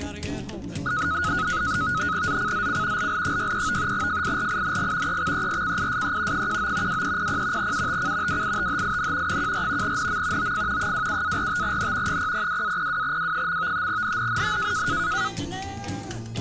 NAVTEX (SITOR-B), 100 baud, 170 Hz shift, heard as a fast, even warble, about 1360 Hz centre. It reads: ZCZC LL63 FIRING EXERCISE 19 2300 UTC WITHIN 14 NM OF 27-45N 002-02W. NNNN